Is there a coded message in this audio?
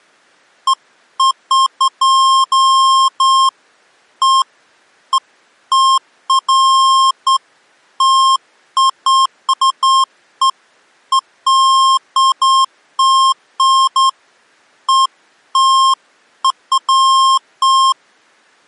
No, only beeps of irregular length.